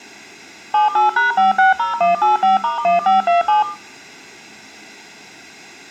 DTMF, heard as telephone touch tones, dialled by machine, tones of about 140 ms, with room echo. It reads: 78#560185*1527